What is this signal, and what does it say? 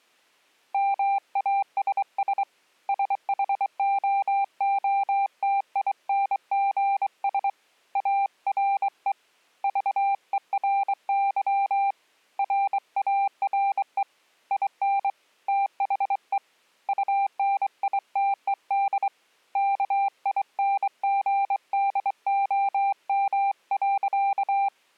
Morse code, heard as a keyed tone, hand-sent with a straight key, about 23 wpm, 790 Hz. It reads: MASS SHOOTINGS ARE VERY RARE IN THE UNITED KINGDOM.